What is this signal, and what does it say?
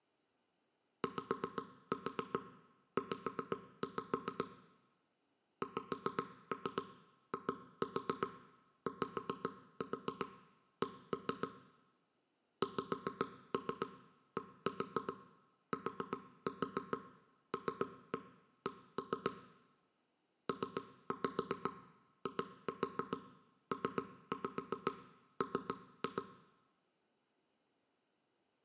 Tap code, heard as knocks on wood, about 7 knocks a second, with room echo. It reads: YZ XIYC XDTLC PIPM